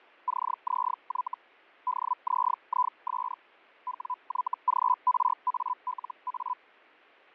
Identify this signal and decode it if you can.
Hellschreiber (Feld-Hell, 122.5 baud), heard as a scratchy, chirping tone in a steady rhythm, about 1000 Hz, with fading. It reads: CZY DZIS WYGRALA